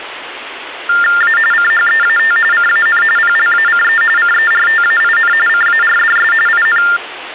TTY/TDD text telephone tones (45.45 baud Baudot), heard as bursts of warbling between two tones, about 400 Hz shift, 1600 Hz centre, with phone line noise. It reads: A CHEAT CAN PLACE CERTAIN CARDS IN